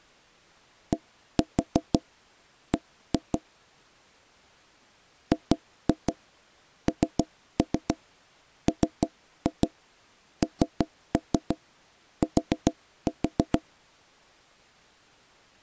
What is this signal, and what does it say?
Tap code, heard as knocks on wood, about 6 knocks a second. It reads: DB GNMNT